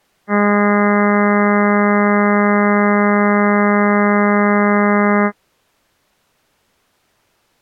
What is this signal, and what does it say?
Ship horn signal, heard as a ship's horn, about 200 Hz. 1 long. At sea: a vessel nearing a blind bend, or under power and making way in fog.